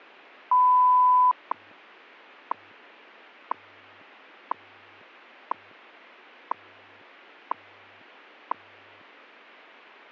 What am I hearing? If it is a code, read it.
Radio time signal (WWV, Colorado), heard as ticks, one a second.